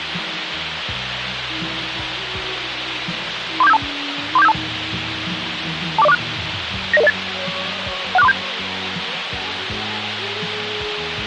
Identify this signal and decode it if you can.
Five-tone selective call (EIA), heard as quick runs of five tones, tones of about 30 ms, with radio hiss. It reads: 34752 34752 24046 90008 16437